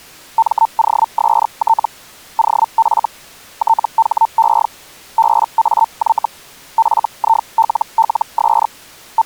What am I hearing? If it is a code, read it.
Hellschreiber (Feld-Hell, 122.5 baud), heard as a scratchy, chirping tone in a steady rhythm, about 900 Hz. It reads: MOST OF THE BAY FILLS …